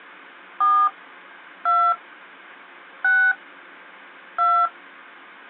DTMF, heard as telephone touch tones, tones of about 270 ms. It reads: 4 2 6 2